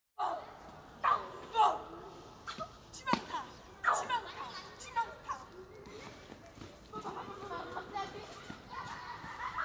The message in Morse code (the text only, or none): none